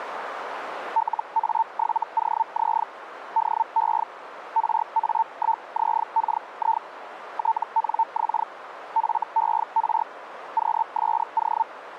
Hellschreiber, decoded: LA7OZ DE RA1ZKI TNX FER QSO

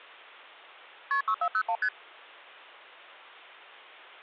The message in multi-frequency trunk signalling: KP 6401 ST

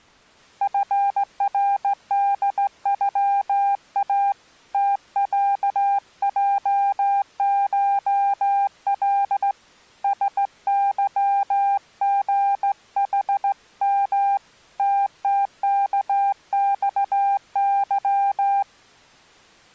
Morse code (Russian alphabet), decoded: ФРДЮА ТЯЙШЛ СЫГХМ ТТКЬЫ

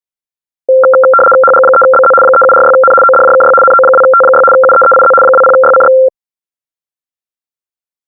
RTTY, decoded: HG3BZ 3746N ODJKY NO2T6 UEEIZ 20YCX

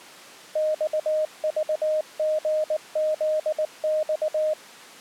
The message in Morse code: XVGZX

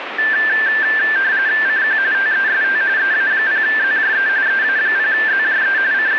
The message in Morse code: none

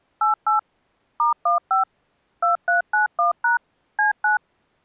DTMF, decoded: 88 *15 2391# C9

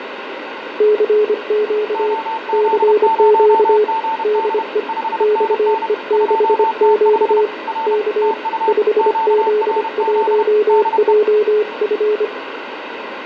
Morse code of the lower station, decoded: CQ CQ DE XE6Q K 5Z1JF

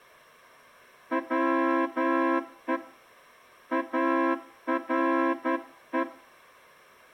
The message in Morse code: WE ARE

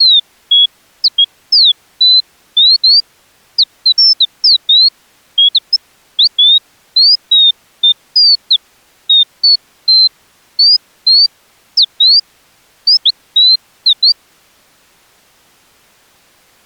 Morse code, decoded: none

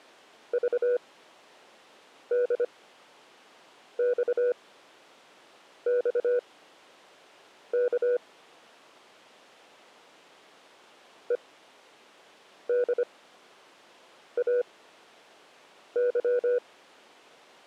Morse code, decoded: VDXXK EDAY

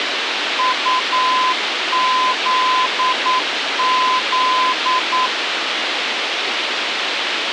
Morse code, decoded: UZZ

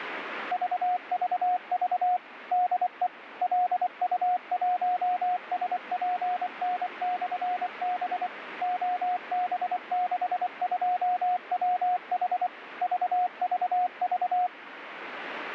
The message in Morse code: VVV DE LU1SPN/B OB62WH VVV

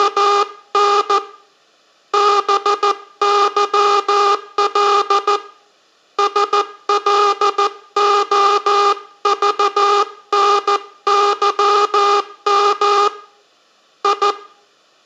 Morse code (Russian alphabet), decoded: … БЫЛ СЛОЖНЫМ И

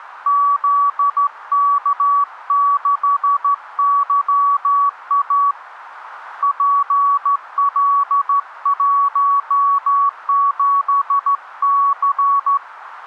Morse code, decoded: ZK6YA PL17C

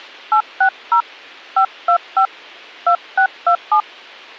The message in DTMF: 860 525 2627

